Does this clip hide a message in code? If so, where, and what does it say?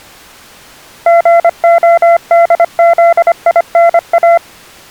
Yes: Morse code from 1.0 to 4.4 s, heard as a keyed tone, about 25 wpm, 680 Hz. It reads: GODZINA